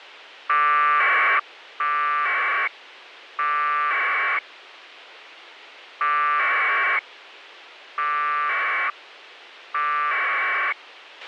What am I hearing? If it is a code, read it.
Packet radio (AX.25, as in APRS), 1200 baud, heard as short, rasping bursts, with radio hiss and a squelch burst at the end.